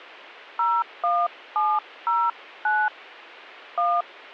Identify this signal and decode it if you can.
DTMF, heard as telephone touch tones, dialled by hand, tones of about 230 ms. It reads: 01709 1